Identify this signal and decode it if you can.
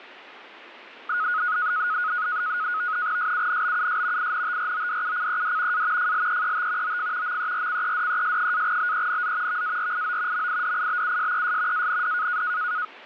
NAVTEX (SITOR-B), 100 baud, 170 Hz shift, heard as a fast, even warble, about 1360 Hz centre. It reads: SUNBUS INTRODUCED A FLEET OF MERCEDES-BENZ VARIO MIDIBUSES AND